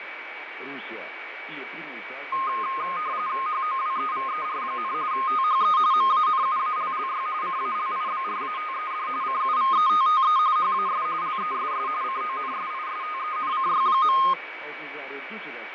RTTY (45.45 baud, 170 Hz shift), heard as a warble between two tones, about 1150 Hz centre, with radio static, fading and a steady whistle near 2280 Hz. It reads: HOWEVER, THE MANUALLY CALIBRATED CUVETTE HAS LESS CONSISTENCY.